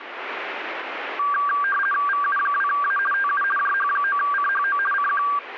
RTTY (50 baud, 450 Hz shift), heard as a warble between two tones, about 1370 Hz centre, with radio static. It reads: VU2A TU JH9CHO CQ